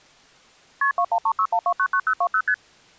Multi-frequency trunk signalling (R1, as on North American trunks), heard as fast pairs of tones, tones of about 70 ms. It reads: KP 21361299020 ST